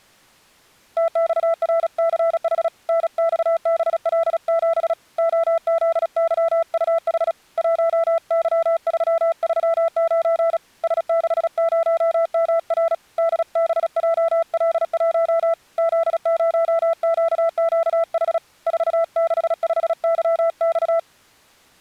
Morse code, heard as a keyed tone, hand-sent with a paddle, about 36 wpm, 660 Hz. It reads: TXRCH NXBL7 OZYUH 1Y339 S60MR DBJL1 Z0QQH 465YX